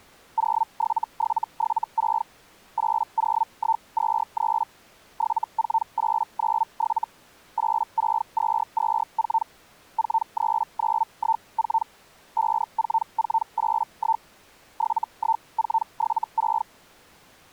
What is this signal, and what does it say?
Hellschreiber (Feld-Hell, 122.5 baud), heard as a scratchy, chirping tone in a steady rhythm, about 900 Hz. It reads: 07776 80123 74897 86224 43914 54481 71476